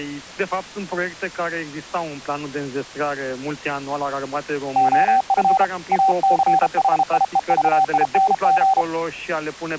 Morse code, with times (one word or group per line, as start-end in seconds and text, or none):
4.8-5.6 OF
5.9-8.8 ACHIEVING